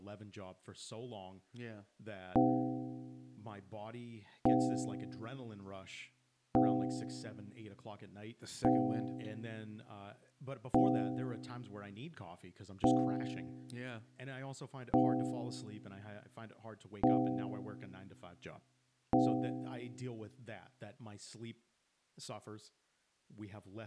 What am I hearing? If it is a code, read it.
Clock strike, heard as a bell, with speech in English. 9. Nine o'clock.